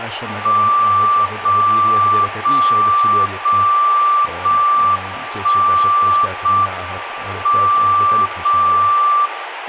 Radio time signal (JJY), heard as a tone whose level steps once a second, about 1170 Hz, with radio static and speech in Hungarian. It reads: 0 0 0 0 1 0 M 0 0